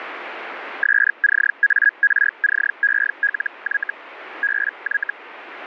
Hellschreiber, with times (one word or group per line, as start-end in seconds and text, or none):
0.8-3.9 SCARCELY
4.4-5.1 BY